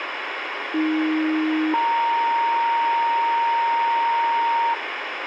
Two-tone page, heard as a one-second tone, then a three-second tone, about 310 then 930 Hz, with radio hiss.